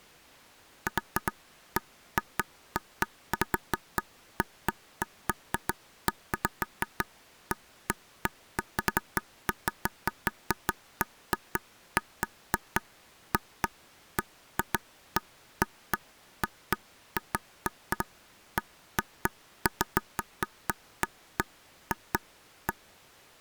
Irregular taps on a table. There is no code.